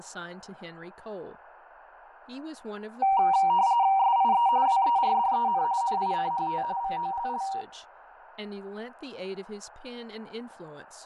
RTTY (45.45 baud, 170 Hz shift), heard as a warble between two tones, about 860 Hz centre, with radio static, fading and speech in English. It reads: SIE WERDEN NICHT VOLL